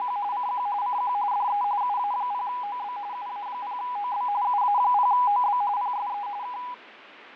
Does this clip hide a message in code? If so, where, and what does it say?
Yes: RTTY (45.45 baud, 170 Hz shift) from 0.0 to 6.7 s, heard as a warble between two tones, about 900 Hz centre, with radio static and fading. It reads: … CQ CQ DE UA0OB UA0OB UA0OB PSE K